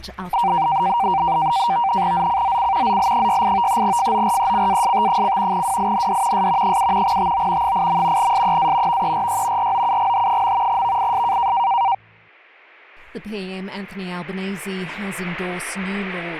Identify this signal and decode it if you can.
NAVTEX (SITOR-B), 100 baud, 170 Hz shift, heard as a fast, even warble, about 860 Hz centre. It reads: ZCZC ZL68 FORECAST: WIND S 7 TO 8. SEA VERY ROUGH. VIS